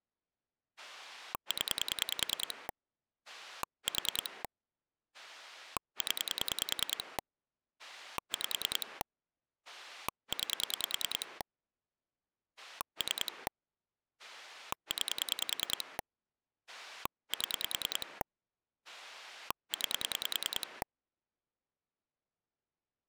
Pulse dialling, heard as a rotary dial, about 10 pulses a second. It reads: 0 4 0 5 9 3 9 7 9